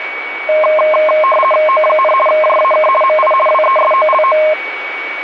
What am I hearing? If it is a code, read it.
RTTY (50 baud, 450 Hz shift), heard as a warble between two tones, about 840 Hz centre, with radio static and a steady whistle near 2250 Hz. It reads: O, JAK MI WESOLO